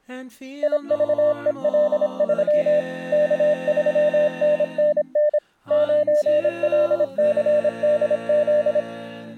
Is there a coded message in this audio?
Yes: Morse code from 0.6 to 8.9 s, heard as a keyed tone, machine-sent, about 26 wpm, 600 Hz. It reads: IVEL3 K3NNN 9LCDZ